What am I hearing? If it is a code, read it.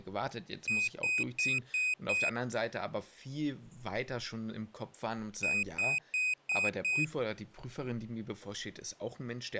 Beep code, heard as a piezo beeper, played twice, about 2500 Hz, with speech in German. 5 short. In AMI BIOS tables: processor failure; in Dell tables: CMOS battery failure.